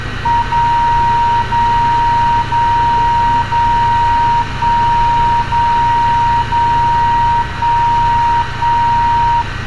Radio time signal (DCF77), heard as a tone whose level steps once a second, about 940 Hz, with static crashes, room echo and street noise. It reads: 0 0 0 0 1 0 0 1 1